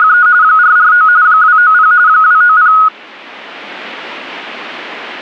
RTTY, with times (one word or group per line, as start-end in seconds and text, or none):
0.0-0.3 …
0.4-1.1 449
1.2-1.9 290
2.1-2.7 290